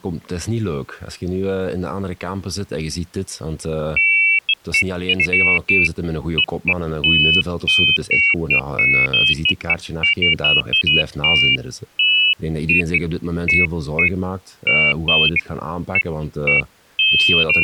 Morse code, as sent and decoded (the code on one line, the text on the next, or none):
none